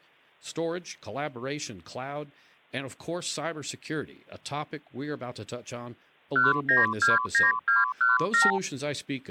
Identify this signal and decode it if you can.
Multi-frequency trunk signalling (R2, with the far end's replies), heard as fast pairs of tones, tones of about 160 ms, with speech in English. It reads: 1929217